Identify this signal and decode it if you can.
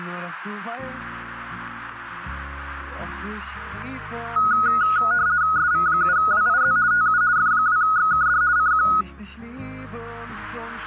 RTTY (50 baud, 170 Hz shift), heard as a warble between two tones, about 1360 Hz centre. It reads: SV7WIZ TU F2XKD CQ